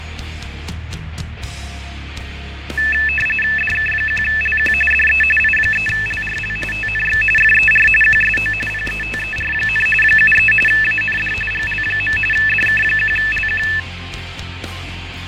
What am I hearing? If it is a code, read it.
RTTY (45.45 baud, 850 Hz shift), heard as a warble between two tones, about 2200 Hz centre, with radio static and fading. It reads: DK1LQ DE I3LRL TNX FER QSO PETER, 73 AND GL. DK1LQ